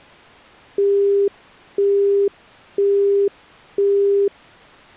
Telephone call progress tone (single-tone plan, as in Europe, Japan and elsewhere), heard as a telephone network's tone, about 400 Hz, 0.5 s on and 0.5 s off. Busy tone.